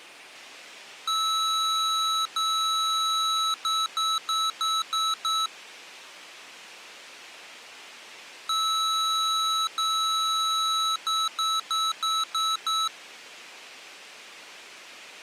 Beep code, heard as beeps from a small speaker, played twice, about 1300 Hz. 2 long, 6 short.